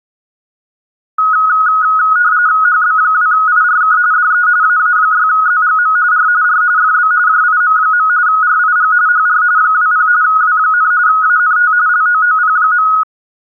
RTTY (45.45 baud, 170 Hz shift), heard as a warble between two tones, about 1360 Hz centre. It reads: HB2IRK DE AA6ZGM R R FB JIM. RIG HR 20 W, ANT LOOP.